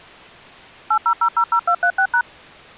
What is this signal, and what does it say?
DTMF, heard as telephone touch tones, dialled by machine, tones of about 80 ms. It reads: 80000236#